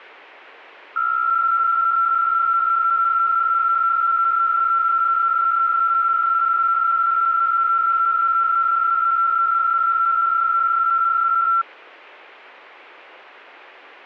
PSK63 (62.5 baud), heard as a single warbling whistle, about 1350 Hz.